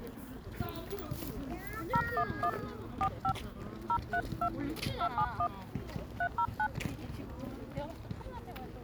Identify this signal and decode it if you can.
DTMF, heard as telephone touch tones, dialled by hand, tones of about 70 ms, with the noise of a park. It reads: 011 45 032 271 309